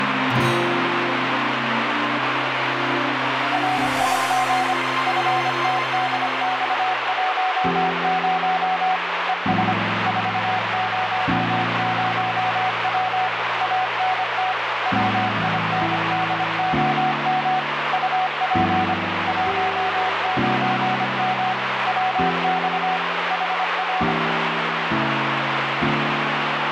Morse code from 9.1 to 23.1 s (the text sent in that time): ES 400W ANT WINDOM UP 19M WX